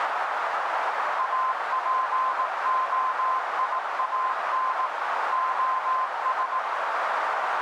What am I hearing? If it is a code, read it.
Morse code, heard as a keyed tone, machine-sent, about 18 wpm, 1040 Hz, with heavy radio static and a narrow filter. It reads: APOIAN OS